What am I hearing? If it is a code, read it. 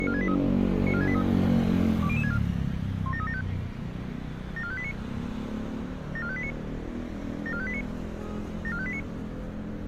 Five-tone selective call (ZVEI), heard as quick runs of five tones, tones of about 70 ms, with street noise. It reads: 94683 94683 20064 17375 74589 74589 74589 74589